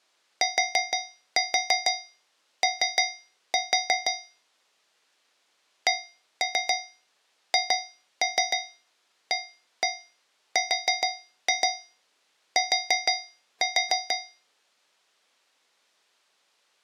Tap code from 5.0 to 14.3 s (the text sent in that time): CHART